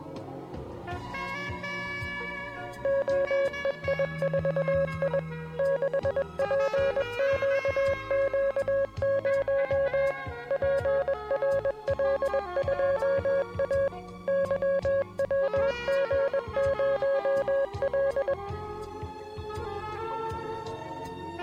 Morse code, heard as a keyed tone, machine-sent, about 21 wpm, 550 Hz. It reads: OEI4I 6PQQ0 PRL2A YWG0L